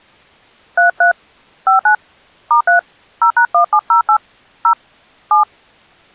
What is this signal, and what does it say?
DTMF, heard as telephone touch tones, dialled by hand, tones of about 100 ms. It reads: 33 59 *3 0#1708 0 7